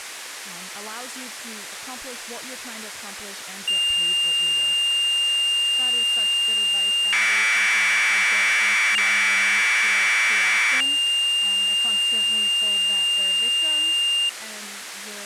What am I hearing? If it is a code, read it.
Commodore tape loading (standard loader), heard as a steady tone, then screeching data, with tape hiss and speech in English.